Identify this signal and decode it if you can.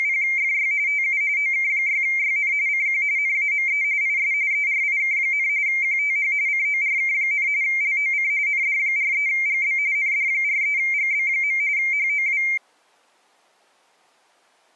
RTTY (45.45 baud, 170 Hz shift), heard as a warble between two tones, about 2200 Hz centre. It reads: … TU OK6YN CQ NAME IS ERIK, QTH CORK, LOC ND43GB ND43GB. HOW